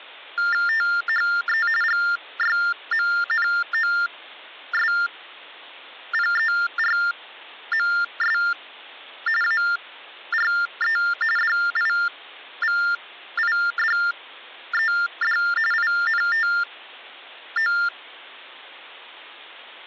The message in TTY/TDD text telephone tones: THE GYMNOSPERMS ARE DIVIDED INTO

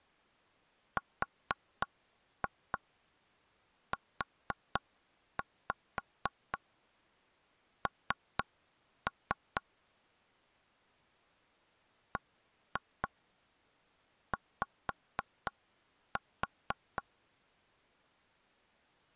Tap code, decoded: RUN BY

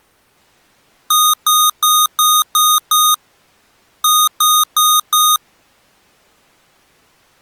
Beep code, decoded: 6-4

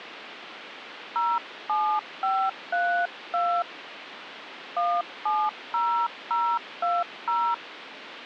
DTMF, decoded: 07532 170020

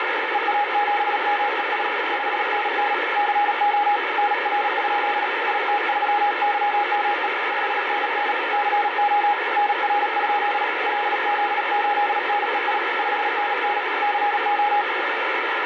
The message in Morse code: EA7MES 5NN CO NR? IT3YME 5NN CO NR? LZ8NEI 5NN CO

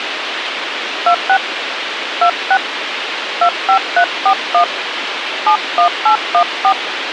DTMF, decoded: 26 26 25341 71814

